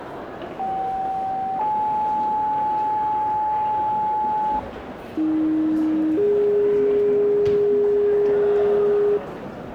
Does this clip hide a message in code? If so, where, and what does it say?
Yes: two-tone page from 0.6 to 9.2 s, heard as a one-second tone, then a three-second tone, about 770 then 860 Hz, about 310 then 410 Hz, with the noise of a crowd indoors.